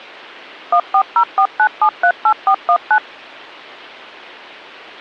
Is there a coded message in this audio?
Yes: DTMF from 0.7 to 3.0 s, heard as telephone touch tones, dialled by machine, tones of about 80 ms. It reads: 14049738419